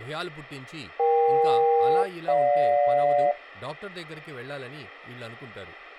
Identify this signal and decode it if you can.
Aircraft SELCAL, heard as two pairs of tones, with speech in Telugu. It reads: EK-GJ